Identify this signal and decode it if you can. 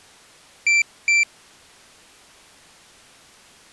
Beep code, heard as a piezo beeper, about 2350 Hz. 2 short. In AMI BIOS tables: memory parity error; in IBM BIOS tables: self-test error shown on screen; in Dell tables: no memory detected.